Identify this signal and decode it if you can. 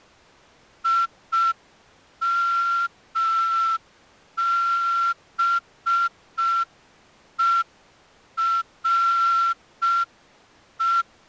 Morse code, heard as a whistle, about 5 wpm. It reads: IMBERE